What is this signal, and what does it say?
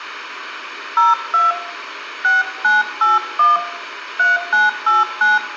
DTMF, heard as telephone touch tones, dialled by hand, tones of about 170 ms, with radio hiss and room echo. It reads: 02 6981 3989